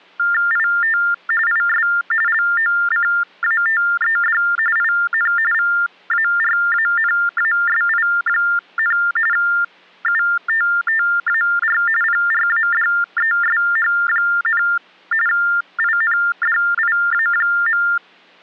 TTY/TDD text telephone tones (45.45 baud Baudot), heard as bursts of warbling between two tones, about 400 Hz shift, 1600 Hz centre. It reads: IT IS LOCATED IN VARANASI, UTTAR PRADESH, INDIA.